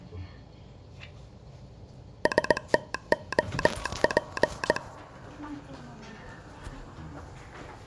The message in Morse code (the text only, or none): STOP